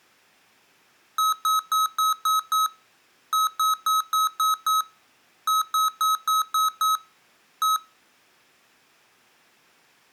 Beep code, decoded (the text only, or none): 6-6-6-1